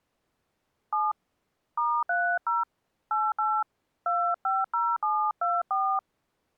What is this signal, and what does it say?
DTMF, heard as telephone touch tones, dialled by hand, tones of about 200 ms. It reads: 7 *30 88 250724